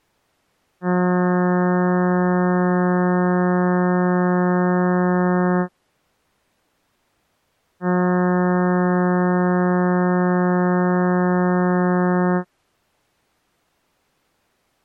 Ship horn signal, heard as a ship's horn, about 180 Hz. 2 long. At sea: a vessel under power that has stopped in fog.